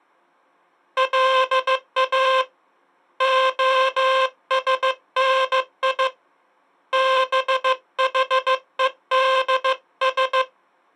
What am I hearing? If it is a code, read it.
Morse code (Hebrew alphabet), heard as a buzzer, hand-sent with a bug key, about 15 wpm. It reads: לא השני בחודש